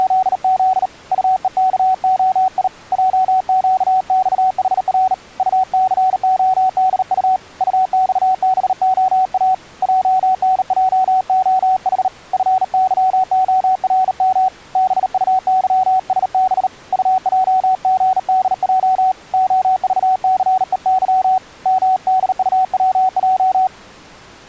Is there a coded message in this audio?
Yes: Morse code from 0.0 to 23.7 s, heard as a keyed tone, hand-sent with a bug key, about 38 wpm, 750 Hz. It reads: … UEKOI JQXHR UCODU UXBOA JNJOH FYORM BUYSB UJGDJ OVCEY MDUWJ